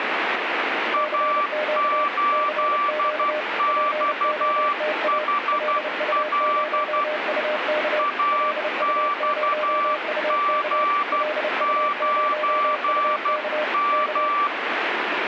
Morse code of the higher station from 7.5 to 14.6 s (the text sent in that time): AXG9M